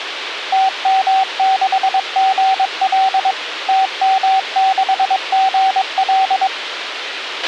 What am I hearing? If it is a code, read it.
Morse code, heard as a keyed tone, machine-sent, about 22 wpm, 770 Hz, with radio hiss and a squelch burst at the end. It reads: TM6GL TM6GL